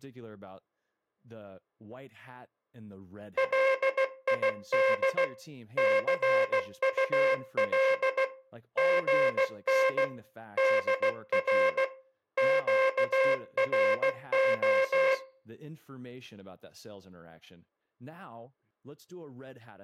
Morse code, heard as a buzzer, machine-sent, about 16 wpm, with speech in English. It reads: LID CUL GN DR QRO